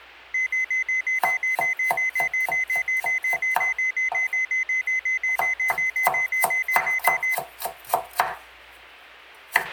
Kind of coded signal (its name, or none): none